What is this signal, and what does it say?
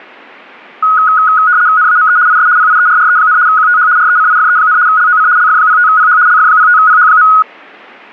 RTTY (75 baud, 170 Hz shift), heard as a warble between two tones, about 1360 Hz centre. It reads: NAME IS PIERRE, QTH RECIFE, LOC LF05PH LF05PH.